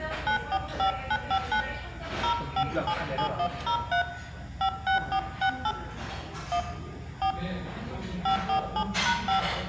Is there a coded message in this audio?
Yes: DTMF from 0.3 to 9.4 s, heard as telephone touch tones, dialled by hand, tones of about 90 ms, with room echo and the noise of a restaurant. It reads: 945959 0577103 56468 1 4 547#5